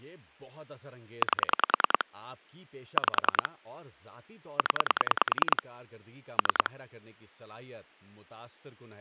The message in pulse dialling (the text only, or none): 8 5 0 3